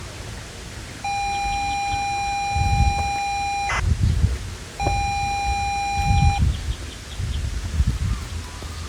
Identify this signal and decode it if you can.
ZX Spectrum tape loading, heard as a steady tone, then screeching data, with the noise of a park.